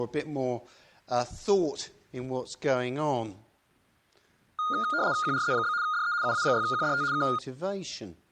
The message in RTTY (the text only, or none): QRZ? DE UA6QDT K